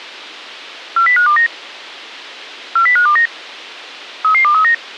Five-tone selective call (CCIR), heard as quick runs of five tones, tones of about 100 ms. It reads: 40529 40529 33239